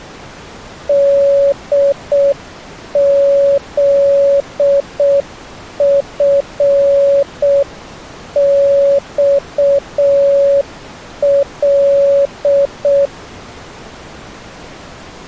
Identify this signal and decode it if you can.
Morse code, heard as a keyed tone, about 6 wpm, 560 Hz. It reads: DZFXL